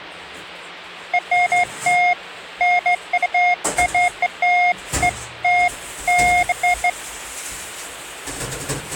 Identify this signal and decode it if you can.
Beeps of irregular length, with kitchen noise. There is no code.